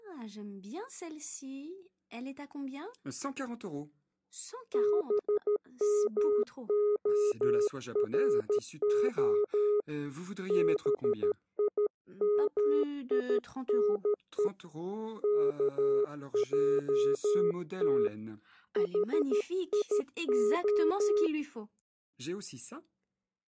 Morse code (Hebrew alphabet), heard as a keyed tone, hand-sent with a paddle, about 13 wpm, 420 Hz. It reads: במהרה בימינו כעת חיה